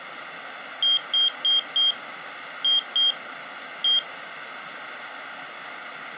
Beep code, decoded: 4-2-1

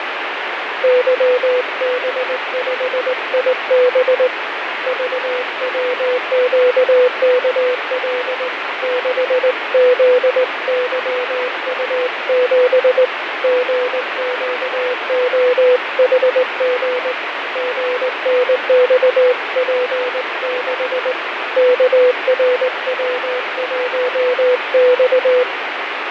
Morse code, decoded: YB5IB VWQKL 6ZYU7 GQOHG GNXP6 KRW1X

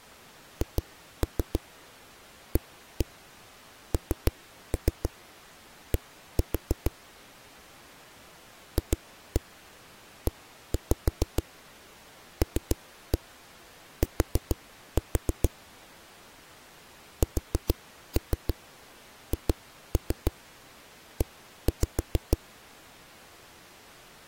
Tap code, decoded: HAND FELT SHE

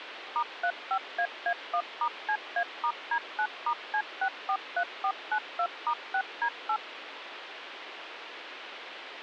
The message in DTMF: *35AA1*CA*D9*C643492*6D8

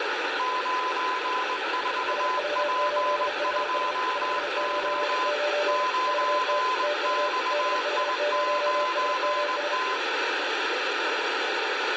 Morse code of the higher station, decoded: 94P2O 9XI9T

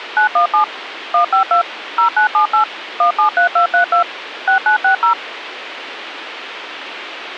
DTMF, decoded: 917 152 0978 173232 6960

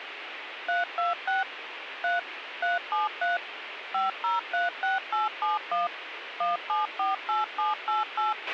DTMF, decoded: 326 3 373 5036871 1748788

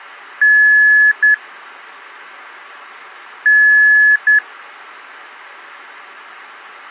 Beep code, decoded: 1 long, 1 short

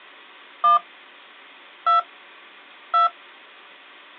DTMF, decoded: 1 2 2

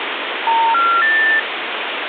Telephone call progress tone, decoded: special information tone

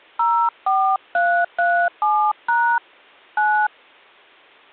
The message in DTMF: 04337# 9

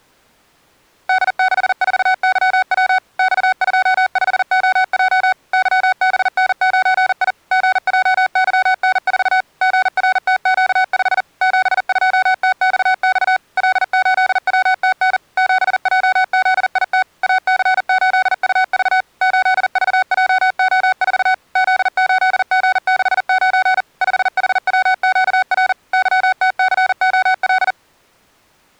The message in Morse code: D64YW X25OJ YBN9I GJYN4 GRTQ5 72TXX L8WTN 7JZIT AC8UV 8VJO4 Z8G69 5HWQR YTCOL

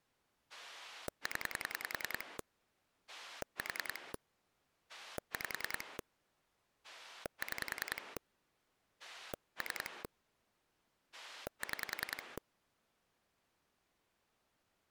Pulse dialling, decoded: 0 4 5 6 3 6

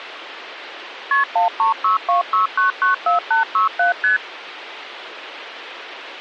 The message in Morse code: none

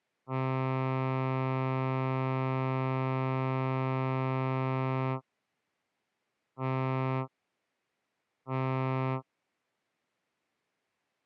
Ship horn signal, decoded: 1 long, 2 short

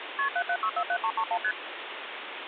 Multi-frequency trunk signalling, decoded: KP 77647331 ST

